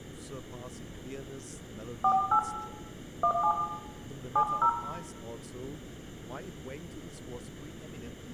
DTMF, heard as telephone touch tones, dialled by hand, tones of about 80 ms, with room echo and speech in English. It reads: 48 17 70